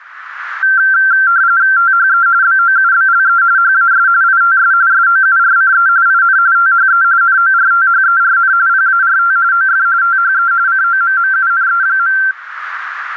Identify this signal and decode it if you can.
RTTY (45.45 baud, 170 Hz shift), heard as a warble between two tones, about 1460 Hz centre, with radio static. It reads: THE BOUBLE HAS ITS SOURCE IN THE NORTHERN PART OF THE COMMUNE.